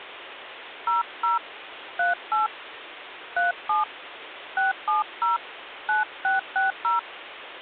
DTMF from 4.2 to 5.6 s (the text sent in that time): 670